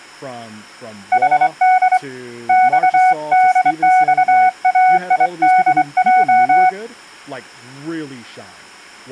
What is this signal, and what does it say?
Morse code, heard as a keyed tone, hand-sent with a straight key, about 24 wpm, 740 Hz, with speech in English. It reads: HD XDXAIDJ